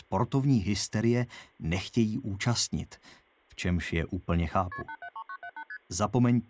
Multi-frequency trunk signalling (R1, as on North American trunks), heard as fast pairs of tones, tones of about 70 ms. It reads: KP 873978 ST